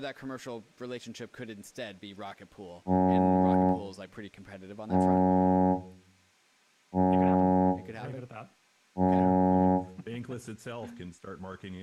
Ship horn signal, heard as a ship's horn, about 90 Hz, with room echo and speech in English. 4 short. At sea: a pilot vessel's identity signal in fog.